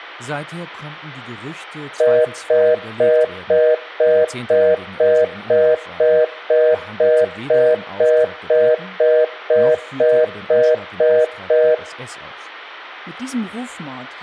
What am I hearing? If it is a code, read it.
Telephone call progress tone (North American plan), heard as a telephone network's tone, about 480, 620 Hz, 0.25 s on and 0.25 s off, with speech in German. Congestion tone.